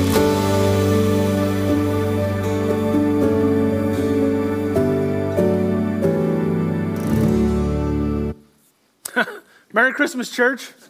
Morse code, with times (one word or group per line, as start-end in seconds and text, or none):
none